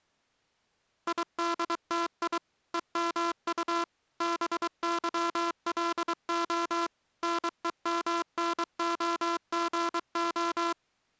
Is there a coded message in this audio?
Yes: Morse code (Russian alphabet) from 1.0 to 10.8 s, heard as a buzzer, machine-sent, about 23 wpm. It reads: ИДТИ ЕМУ БЫЛО НЕМНОГО